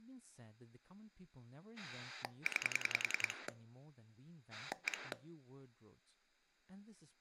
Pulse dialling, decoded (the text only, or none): 9 1